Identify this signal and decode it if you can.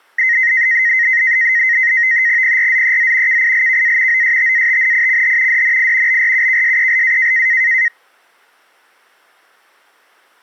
NAVTEX (SITOR-B), 100 baud, 170 Hz shift, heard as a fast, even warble, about 1950 Hz centre. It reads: PRZEZ KILKA OSTATNICH DNI BRUKSELA